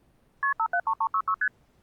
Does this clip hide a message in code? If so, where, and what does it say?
Yes: multi-frequency trunk signalling (R1, as on North American trunks) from 0.4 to 1.5 s, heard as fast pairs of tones, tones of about 70 ms. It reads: KP 573366 ST